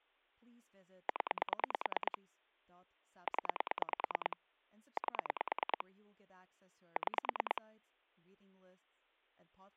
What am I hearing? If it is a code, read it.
Pulse dialling, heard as clicks on a phone line, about 9 pulses a second, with speech in English. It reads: 0 0 8 6